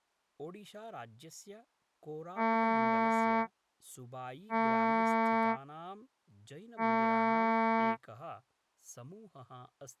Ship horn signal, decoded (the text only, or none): 3 short